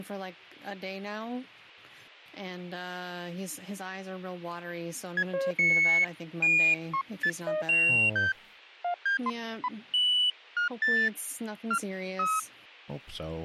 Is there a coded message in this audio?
No, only electronic bleeps of random pitch and length.